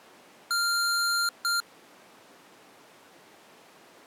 Beep code, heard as beeps from a small speaker, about 1390 Hz. 1 long, 1 short. In IBM BIOS tables: system board problem.